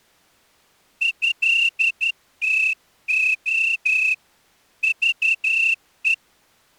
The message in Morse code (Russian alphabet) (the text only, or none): ЭТО ЖЕ